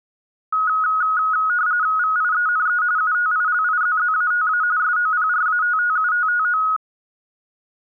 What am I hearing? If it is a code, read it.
RTTY (45.45 baud, 170 Hz shift), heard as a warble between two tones, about 1360 Hz centre. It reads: VIENE UTILIZZATA SOPRATTUTTO